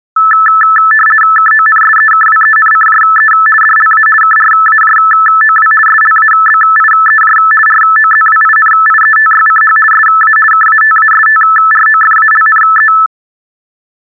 RTTY (50 baud, 450 Hz shift), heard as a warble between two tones, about 1550 Hz centre. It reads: KONSEKWENCJE DLA KRAJOW SLABIEJ ROZWINIETYCH SA KATASTROFALNE